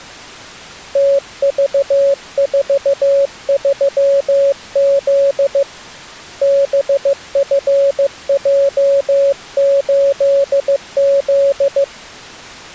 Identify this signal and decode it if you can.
Morse code, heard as a keyed tone, hand-sent with a paddle, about 15 wpm, 560 Hz. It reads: TV43Z BFJ8Z